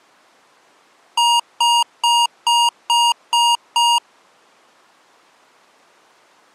Beep code, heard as beeps from a small speaker, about 940 Hz. 7 short. In AMI BIOS tables: virtual mode exception error; in Dell tables: processor failure.